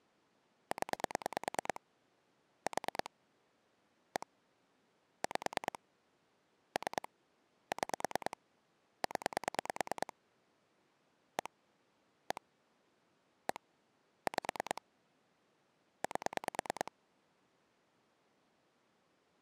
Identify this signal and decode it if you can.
Pulse dialling, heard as clicks on a phone line, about 9 pulses a second. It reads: 0 4 1 5 3 6 0 1 1 1 5 8